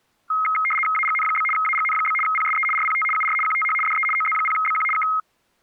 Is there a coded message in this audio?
Yes: RTTY (75 baud, 850 Hz shift) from 0.3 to 5.2 s, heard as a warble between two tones, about 1700 Hz centre. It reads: AGN? AGN? PSE RPT UR QTH DE OZ0BQ K